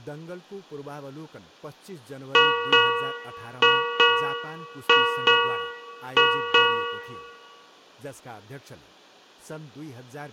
Ship's bell, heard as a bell, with room echo and speech in Nepali. 8. Eight half-hours of the watch have passed.